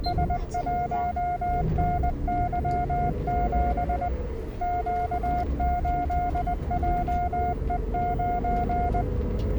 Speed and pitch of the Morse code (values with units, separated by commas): 20 wpm, 710 Hz